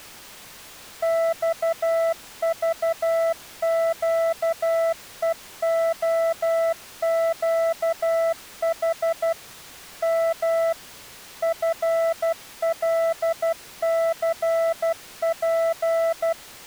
Morse code, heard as a keyed tone, machine-sent, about 12 wpm, 660 Hz. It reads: XVQEOQH M FLCP